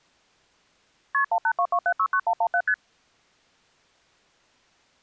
Multi-frequency trunk signalling (R1, as on North American trunks), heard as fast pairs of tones, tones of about 70 ms. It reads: KP 1822769117 ST